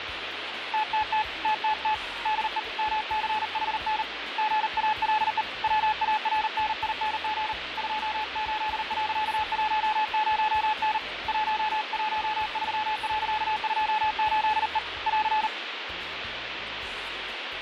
Morse code, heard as a keyed tone, hand-sent with a paddle, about 39 wpm, 860 Hz, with radio static. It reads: TTT TTT DE MCHN GALE WARNING 28.10N 113.28E <AR>